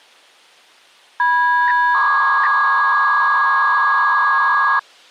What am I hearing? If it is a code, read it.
300-baud modem data (V.21 tones), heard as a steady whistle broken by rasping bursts, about 300 baud, 200 Hz shift.